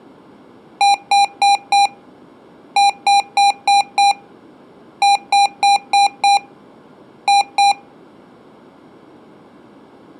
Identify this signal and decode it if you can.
Beep code, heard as beeps from a small speaker, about 800 Hz. 4-5-5-2.